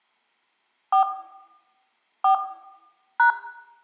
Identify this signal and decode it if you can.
DTMF, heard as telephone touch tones, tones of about 110 ms, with room echo. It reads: 4 4 #